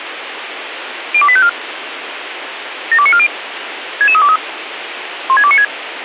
Five-tone selective call (ZVEI), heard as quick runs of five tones, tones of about 70 ms, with radio hiss. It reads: 02854 72940 66323 16296